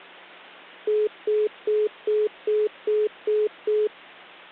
Telephone call progress tone (single-tone plan, as in most of Europe), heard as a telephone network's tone, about 420 Hz, 0.2 s on and 0.2 s off, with hum. Congestion tone.